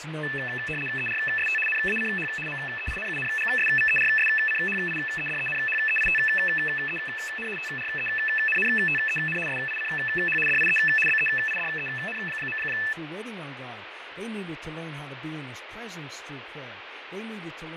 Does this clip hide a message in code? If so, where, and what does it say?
Yes: RTTY (75 baud, 850 Hz shift) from 0.2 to 12.9 s, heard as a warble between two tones, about 2200 Hz centre, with radio static, fading and speech in English. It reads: ERST NACH MEINUNGSVERSCHIEDENHEITEN TRENNTEN SICH DIE BEIDEN.